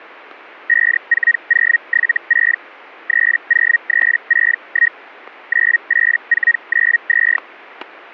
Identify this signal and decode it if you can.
Hellschreiber (Feld-Hell, 122.5 baud), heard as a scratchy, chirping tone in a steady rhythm, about 1900 Hz, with static crashes. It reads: 54076 30361 98492